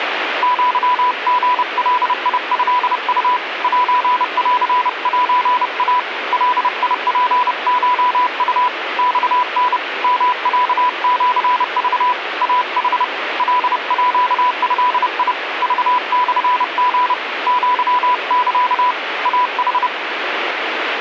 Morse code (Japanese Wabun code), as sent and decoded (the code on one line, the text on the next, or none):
--.-- --. .-.. .. ..-.. ..- / .---. .-.-. .---. .- / .-.. .. .--. ---- ..- / -..- -. / -- .-.- --.-. ...- / .- .... / .-.. .--.- ..-.. .. / ...- -..-. --. / --.-- -.-.- / .- ....
アリガトウ センセイ ガツコウ マタ ヨロシク イヌ カード クモリ アサ イヌ